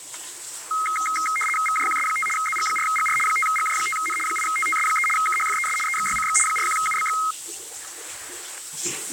RTTY (75 baud, 850 Hz shift), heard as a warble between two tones, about 1700 Hz centre, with static crashes and the noise of a restroom. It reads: VJQS5 ZG4GR 5GJ5N 8TTS3 KHFES EXYCX 41UBX